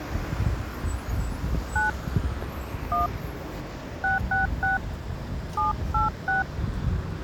DTMF, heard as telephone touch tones, dialled by hand, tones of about 150 ms, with the noise of a residential street. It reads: 9 1 666 786